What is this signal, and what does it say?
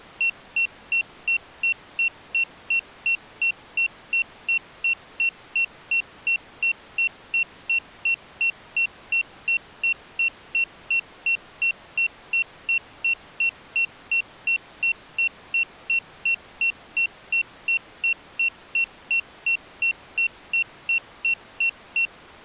Evenly repeated beeps. There is no code.